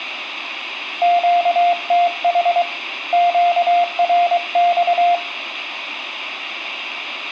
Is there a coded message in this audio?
Yes: Morse code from 1.0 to 5.2 s, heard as a keyed tone, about 23 wpm, 700 Hz, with radio static and room echo. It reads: QTH QRX